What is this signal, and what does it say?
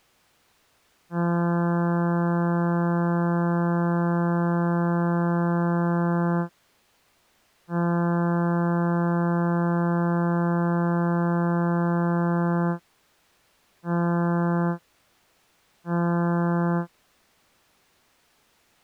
Ship horn signal, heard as a ship's horn, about 170 Hz. 2 long, 2 short. At sea: I intend to overtake on your port side.